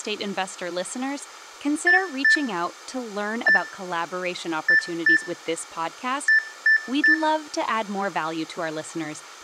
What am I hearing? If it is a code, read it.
Beep code, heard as beeps, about 1750 Hz, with room echo and speech in English. 2-1-2-3. In Phoenix BIOS tables: ROM copyright notice check failure.